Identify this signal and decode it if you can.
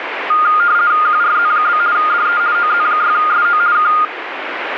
RTTY (50 baud, 170 Hz shift), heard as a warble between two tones, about 1320 Hz centre, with radio static. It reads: QRZ? DE OZ6SO K